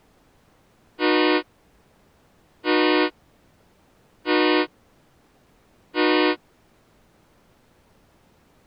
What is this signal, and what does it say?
Train horn signal, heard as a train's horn. 4 short. On North American railways: a request for a signal to be given or repeated.